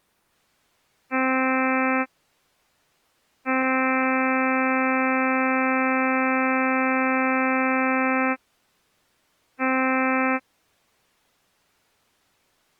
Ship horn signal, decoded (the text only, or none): 1 short, 1 long, 1 short